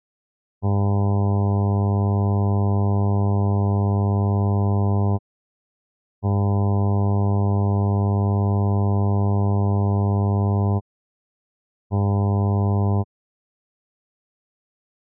Ship horn signal, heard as a ship's horn, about 100 Hz. 2 long, 1 short. At sea: I intend to overtake on your starboard side.